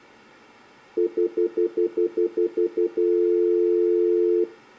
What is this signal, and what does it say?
Telephone call progress tone (North American plan), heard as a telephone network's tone, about 350, 440 Hz, 0.1 s on and 0.1 s off. Stutter dial tone.